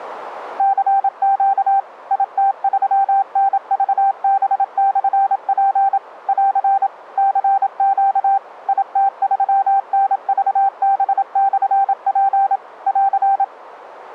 Morse code, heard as a keyed tone, machine-sent, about 27 wpm, 790 Hz. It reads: CQ IT3NVB/P <AR> CQ IT3NVB/P <AR>